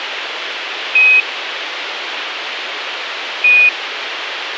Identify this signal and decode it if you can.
Quindar tones, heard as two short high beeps, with radio hiss.